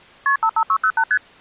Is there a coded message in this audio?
Yes: multi-frequency trunk signalling (R1, as on North American trunks) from 0.3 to 1.2 s, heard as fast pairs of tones, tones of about 70 ms. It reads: KP 55608 ST